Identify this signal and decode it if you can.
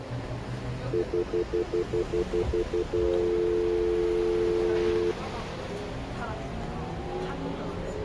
Telephone call progress tone (North American plan), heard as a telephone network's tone, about 350, 440 Hz, 0.1 s on and 0.1 s off, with the noise inside a bus. Stutter dial tone.